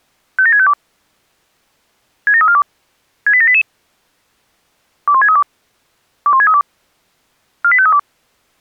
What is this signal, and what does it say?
Five-tone selective call (ZVEI), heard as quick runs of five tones, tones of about 70 ms. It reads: 57652 67342 68788 21632 21632 48532